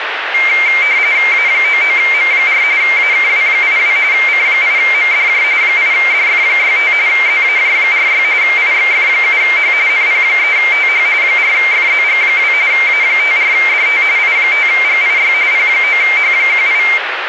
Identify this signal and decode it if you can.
RTTY (45.45 baud, 170 Hz shift), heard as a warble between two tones, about 2200 Hz centre, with radio static. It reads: A99M4 AKW82 C8MDJ 8DF65 ZAJ46 IXF7H NP3TH 4FZG2 A54DT I5GIY P9H18